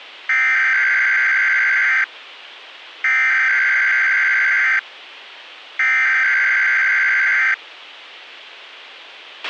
Emergency Alert System (SAME) tones (header bursts), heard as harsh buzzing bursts, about 520.83 baud, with a squelch burst at the end.